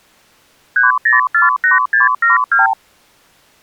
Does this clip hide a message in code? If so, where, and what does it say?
Yes: multi-frequency trunk signalling (R2, with the far end's replies) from 0.8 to 2.7 s, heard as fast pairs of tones, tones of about 150 ms. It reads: 3048672